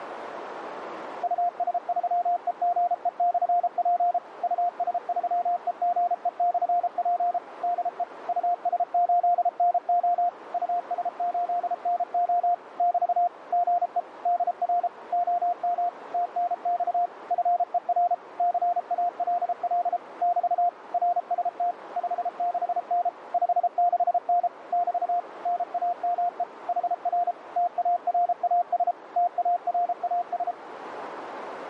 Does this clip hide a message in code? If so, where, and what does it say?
Yes: Morse code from 1.2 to 30.6 s, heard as a keyed tone, machine-sent, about 33 wpm, 700 Hz, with radio static and a narrow filter. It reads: US3EGE/P US3EGE/P DE US8NO US8NO <BT> GE DR OM TNX FER CALL <BT> RST 56N 56N <BT> NAME HR TARAS TARAS